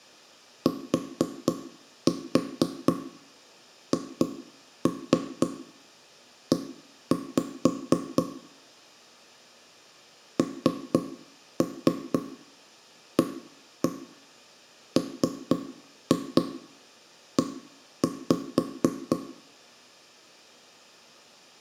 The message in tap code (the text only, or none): THE NAME